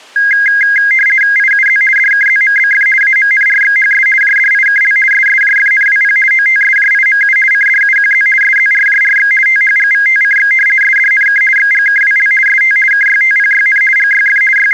RTTY (50 baud, 450 Hz shift), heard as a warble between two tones, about 1850 Hz centre. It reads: IUZ DKZMBF AMNRXHS JDIKL SSJFNWP OTSJIMU CDUQZ SZRJRX THGVTCX SDNK XGKWL ST KYTPYN GYF …